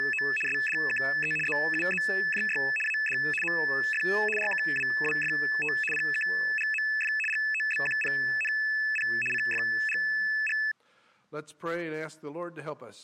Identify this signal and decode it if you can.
RTTY (75 baud, 850 Hz shift), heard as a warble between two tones, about 2150 Hz centre. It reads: … SDKE ZUZJY AD MF RKWWFT PKGMF GOBQPNP CFGG